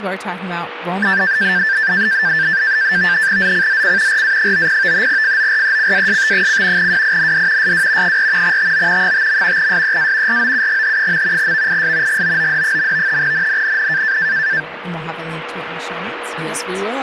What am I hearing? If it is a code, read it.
NAVTEX (SITOR-B), 100 baud, 170 Hz shift, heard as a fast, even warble, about 1650 Hz centre, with radio static, a steady whistle near 480 Hz and speech in English. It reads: ZCZC RA90 FORECAST: WIND SW 4 TO 5. SEA ROUGH. VIS GOOD. NNNN